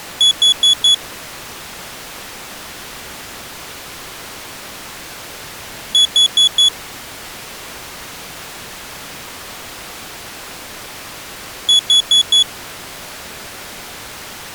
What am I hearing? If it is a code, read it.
Alarm pattern, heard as an alarm's beeps, played three times, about 3400 Hz. Temporal four. Carbon monoxide.